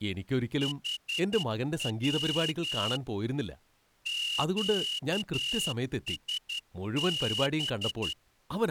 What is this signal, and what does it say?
Morse code, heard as a whistle, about 11 wpm, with speech in Malayalam. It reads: HW QSB